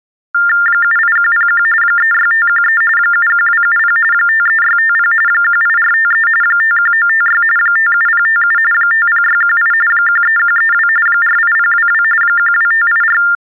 TTY/TDD text telephone tones (45.45 baud Baudot), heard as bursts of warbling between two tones, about 400 Hz shift, 1600 Hz centre. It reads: 78101 36513 71270 53650 18453 51956 57057 50618 13132 48022 12584